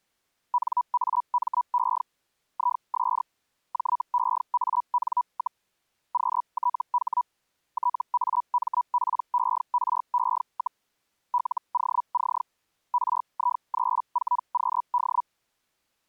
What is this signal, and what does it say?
Hellschreiber (Feld-Hell, 122.5 baud), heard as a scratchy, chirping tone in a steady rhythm, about 980 Hz. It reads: NAME IS JEAN, QTH TAMPERE, LOC RI34QD